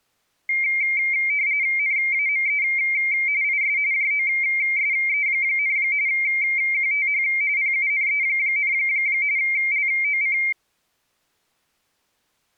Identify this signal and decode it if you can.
RTTY (45.45 baud, 170 Hz shift), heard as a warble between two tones, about 2200 Hz centre. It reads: NAME IS JOSE, QTH PUNE, LOC